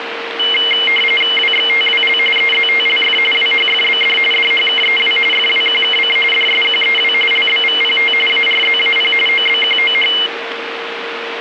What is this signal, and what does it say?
RTTY (45.45 baud, 850 Hz shift), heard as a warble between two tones, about 2550 Hz centre, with radio static and a steady whistle near 460 Hz. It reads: WXTWL EZTLF WHFBD DHKEW FWQKC DSQEW LBVPT ARZAP OBQOH